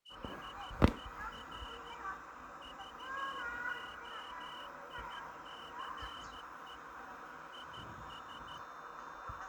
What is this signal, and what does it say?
Morse code, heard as a whistle, hand-sent with a straight key, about 13 wpm, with the noise of a park. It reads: HER VOICE IS